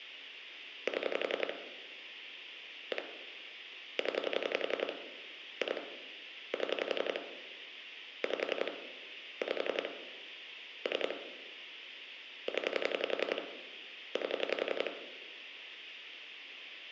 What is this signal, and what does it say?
Pulse dialling, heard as clicks on a phone line, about 11 pulses a second, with phone line noise and room echo. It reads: 7 1 0 2 7 5 5 3 0 8